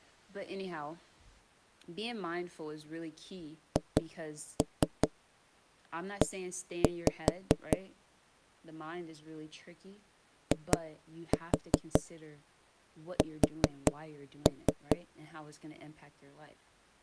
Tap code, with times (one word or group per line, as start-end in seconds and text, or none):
3.8-7.8 HE
10.5-15.0 IS